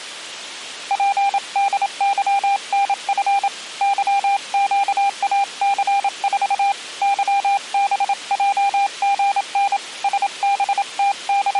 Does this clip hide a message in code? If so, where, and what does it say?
Yes: Morse code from 0.8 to 11.6 s, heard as a keyed tone, hand-sent with a paddle, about 27 wpm, 800 Hz. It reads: PDYNF YQAC4 YBJGN …